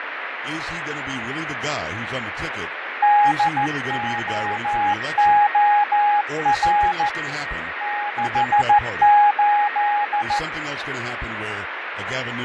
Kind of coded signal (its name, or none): Morse code